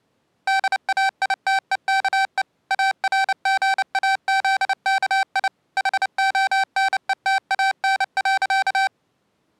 Morse code, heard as electronic beeps, machine-sent, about 29 wpm, 780 Hz. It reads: DAITEKE ARGAZKI HONETAN.